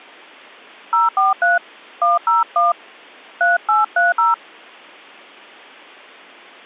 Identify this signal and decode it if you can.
DTMF, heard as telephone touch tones, dialled by hand, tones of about 160 ms. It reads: 043 101 3830